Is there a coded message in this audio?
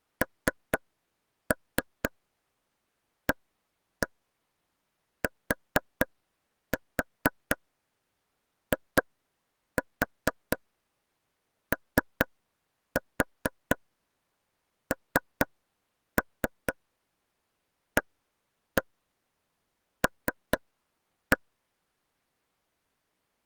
Yes: tap code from 0.2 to 21.4 s, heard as taps on a table, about 4 knocks a second. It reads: NATIONAL